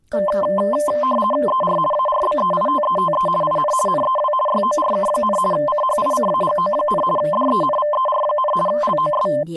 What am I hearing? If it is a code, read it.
RTTY (50 baud, 450 Hz shift), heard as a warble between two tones, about 820 Hz centre, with speech in Vietnamese. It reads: ER ARBEITETE IN NEW YORK, CHICAGO, DENVER, LOS